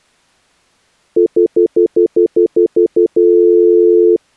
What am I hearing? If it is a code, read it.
Telephone call progress tone (North American plan), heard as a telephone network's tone, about 350, 440 Hz, 0.1 s on and 0.1 s off. Stutter dial tone.